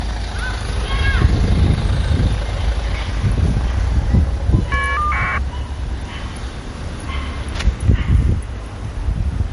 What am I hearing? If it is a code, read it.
Caller ID data burst, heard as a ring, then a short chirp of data, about 1200 baud, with the noise of a residential street.